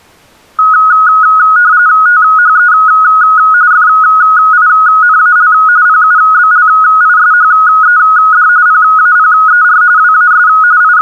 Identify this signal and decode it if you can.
RTTY (45.45 baud, 170 Hz shift), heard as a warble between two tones, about 1360 Hz centre. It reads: THE FINAL PUBLISHED PAPER WAS …